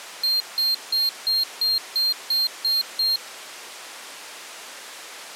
Beep code, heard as a piezo beeper, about 4200 Hz. 9 short. In AMI BIOS tables: ROM checksum failure.